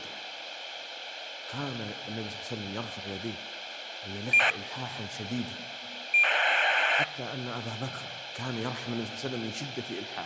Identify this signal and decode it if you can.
ACARS aircraft data, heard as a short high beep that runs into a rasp, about 2400 baud, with radio hiss and a squelch burst at the end.